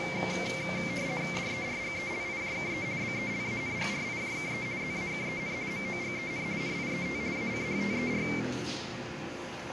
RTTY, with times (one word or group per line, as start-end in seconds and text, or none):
1.4-2.9 DERGELIJKE
3.0-4.7 BELANGRIJKE
4.8-5.5 ZAKEN
5.7-6.5 MOGEN
6.6-7.2 NIET
7.3-8.2 ACHTER